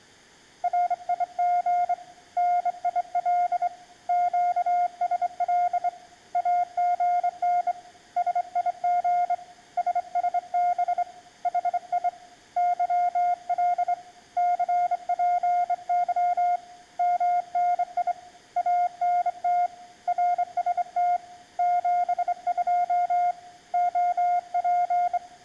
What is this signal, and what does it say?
Morse code, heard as a keyed tone, hand-sent with a straight key, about 25 wpm, 710 Hz. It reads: RIG NIL QSL AGN SIG SSB HI YL CPY MNI ANT RST 72 OP